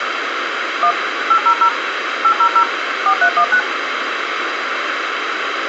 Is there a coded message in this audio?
Yes: DTMF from 0.8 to 3.6 s, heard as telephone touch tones, dialled by machine, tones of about 80 ms, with radio hiss. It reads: 1 800 800 4319